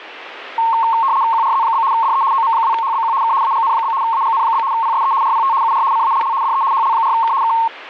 RTTY (75 baud, 170 Hz shift), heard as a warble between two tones, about 1000 Hz centre, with static crashes. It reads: QRZ? DE OM2HBQ K AGN? AGN? PSE RPT UR CALL DE HL4K K